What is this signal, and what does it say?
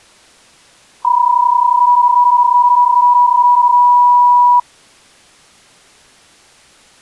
PSK31 (31.25 baud), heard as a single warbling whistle, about 980 Hz.